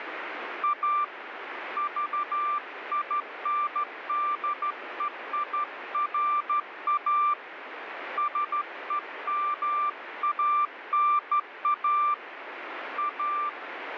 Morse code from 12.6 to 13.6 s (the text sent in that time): A